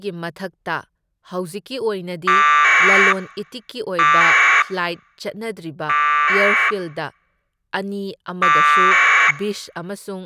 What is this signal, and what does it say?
Packet radio (AX.25, as in APRS), 1200 baud, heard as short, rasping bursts, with speech in Manipuri.